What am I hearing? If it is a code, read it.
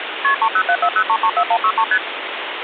Multi-frequency trunk signalling (R1, as on North American trunks), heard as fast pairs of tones, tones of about 70 ms, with phone line noise. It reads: KP 30740334163 ST